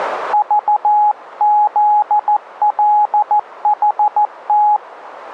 Morse code, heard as a keyed tone, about 14 wpm, 840 Hz. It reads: VZLHT